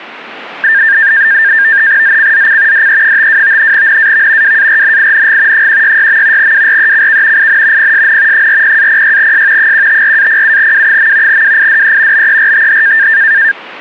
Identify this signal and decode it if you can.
NAVTEX (SITOR-B), 100 baud, 170 Hz shift, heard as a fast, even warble, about 1700 Hz centre. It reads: ZCZC DE52 NAV WARNING 166. WRECK IN PSN 40-06S 154-07W. WIDE BERTH